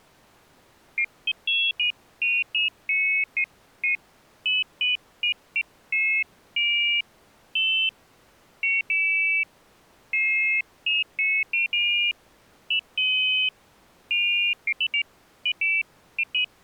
Pairs of high tones at irregular times. There is no code.